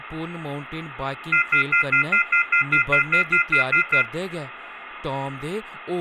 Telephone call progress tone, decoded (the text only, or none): off-hook warning tone